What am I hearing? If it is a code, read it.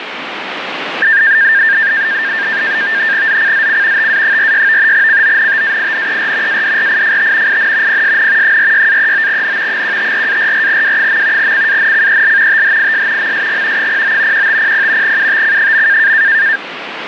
NAVTEX (SITOR-B), 100 baud, 170 Hz shift, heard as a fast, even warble, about 1700 Hz centre, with radio static. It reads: ZCZC TA46 CONTAINER ADRIFT IN PSN 46-39N 154-44W. CANCEL THIS MSG 09 1500 UTC.